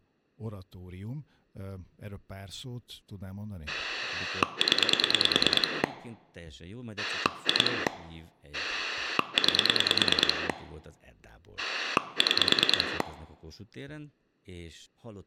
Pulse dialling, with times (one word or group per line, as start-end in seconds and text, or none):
3.7-5.8 0
7.0-7.9 2
8.5-10.5 9
11.6-13.0 6